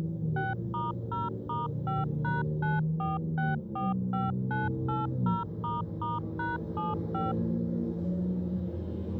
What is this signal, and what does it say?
DTMF, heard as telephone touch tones, dialled by machine, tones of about 170 ms, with the noise inside a car. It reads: 6*0*5#94645980**#75